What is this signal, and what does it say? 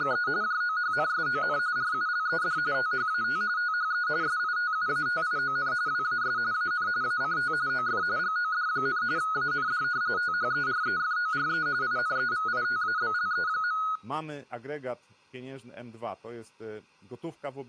RTTY (45.45 baud, 170 Hz shift), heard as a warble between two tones, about 1360 Hz centre, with speech in Polish. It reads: … JOHNSON RULED THAT THE SITUATION WAS AN ACT OF GOD, AND THEREFORE INEVITABLE.